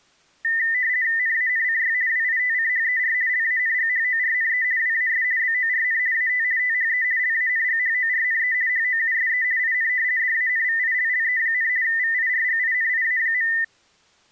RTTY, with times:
1.2-1.9 NANCY
2.1-3.1 WITCHER
3.3-4.6 LANGHORNE
4.8-5.2 WAS
5.4-6.0 BORN
6.1-6.4 AT
6.6-7.0 THE
7.2-8.5 LANGHORNE
8.7-9.4 HOUSE
9.6-9.9 IN
10.2-11.7 DANVILLE,
11.8-13.5 VIRGINIA.

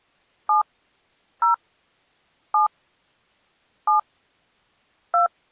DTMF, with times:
0.5-0.6 7
1.4-1.5 0
2.5-2.7 7
3.9-4.0 7
5.1-5.3 2

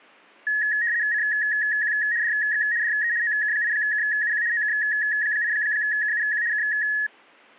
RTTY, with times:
1.1-1.9 CQ
2.2-2.6 DX
2.8-3.1 DE
3.2-4.4 OK8KUQ
4.5-6.4 OK8KUQ
6.5-6.6 K

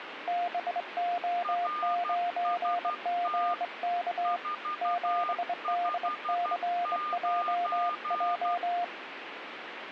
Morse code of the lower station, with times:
0.3-4.4 BO9GK
4.8-8.8 7DCJJ

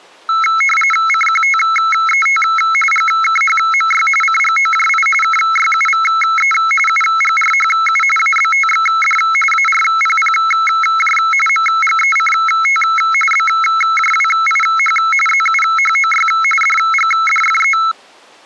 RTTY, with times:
1.1-2.4 CQTET
2.9-4.1 GKHMY
4.2-5.1 CGOJI
5.2-6.5 KYUVE
6.9-8.0 UGRHU
8.2-9.2 ABTXD
9.5-11.2 ARPPJ
11.5-12.8 MGECT
13.3-15.0 BJWIH
15.3-16.3 ZUHOY
16.6-17.8 DGDFE

